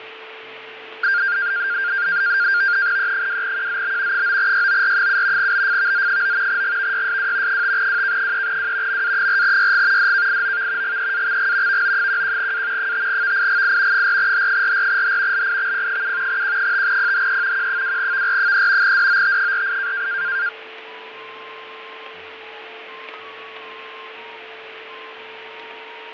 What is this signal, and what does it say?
NAVTEX (SITOR-B), 100 baud, 170 Hz shift, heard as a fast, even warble, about 1500 Hz centre, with radio static, fading and a steady whistle near 440 Hz. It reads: E2QZB 9YOR7 BFVZ9 GVYSW 5WK3W MA4YG DKIOV GEAXG VO11A 5VIGI 4H44H LIXP7 Q5PHE Q2VR3 DOT48